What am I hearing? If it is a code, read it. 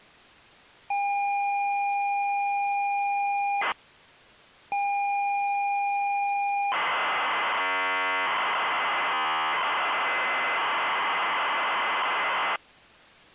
ZX Spectrum tape loading, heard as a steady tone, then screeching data.